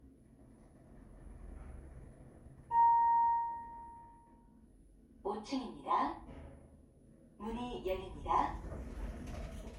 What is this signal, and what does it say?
The noise inside a lift. There is no code.